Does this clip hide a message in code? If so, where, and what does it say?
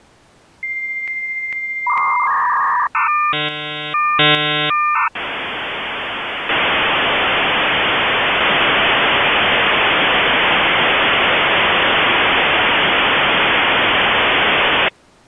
Yes: dial-up modem handshake (V.34 or later) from 0.6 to 14.9 s, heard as a whistle, warbles, then hiss.